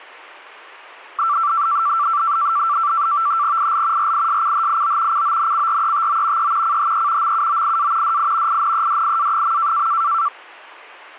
NAVTEX (SITOR-B), 100 baud, 170 Hz shift, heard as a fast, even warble, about 1250 Hz centre. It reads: IL RISCHIO CONCRETO E CHE MUOIA DI INEDIA.